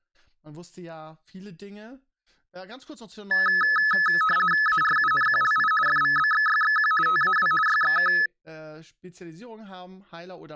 RTTY (50 baud, 450 Hz shift), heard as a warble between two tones, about 1500 Hz centre, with speech in German. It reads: ARUNQLI FVBXYXQ TAW YXK